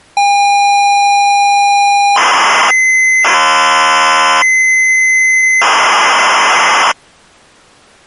ZX Spectrum tape loading, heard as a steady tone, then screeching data.